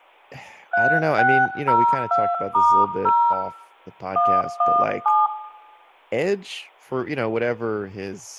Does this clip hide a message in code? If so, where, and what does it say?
Yes: DTMF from 0.7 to 5.3 s, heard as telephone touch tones, dialled by hand, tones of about 270 ms, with room echo and speech in English. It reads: 3602*0 117